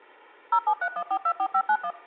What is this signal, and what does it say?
DTMF, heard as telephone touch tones, dialled by machine, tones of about 70 ms. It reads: 0731424591